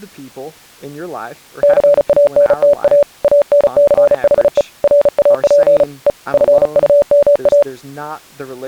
Morse code, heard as a keyed tone, hand-sent with a bug key, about 35 wpm, 580 Hz, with speech in English. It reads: CANTA ANCHE RAP E FUMA